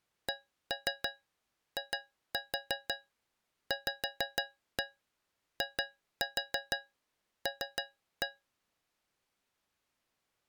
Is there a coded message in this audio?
Yes: tap code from 0.3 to 8.4 s, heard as taps on a metal pipe, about 6 knocks a second. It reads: CIVIL